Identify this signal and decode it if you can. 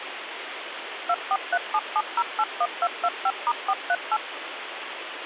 DTMF, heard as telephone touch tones, dialled by machine, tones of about 50 ms, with phone line noise. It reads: 24377081225*438